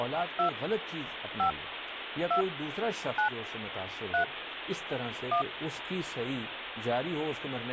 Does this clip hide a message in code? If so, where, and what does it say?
Yes: DTMF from 0.4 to 5.4 s, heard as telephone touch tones, dialled by hand, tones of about 110 ms, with phone line noise. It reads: 2 5 2 9 3 1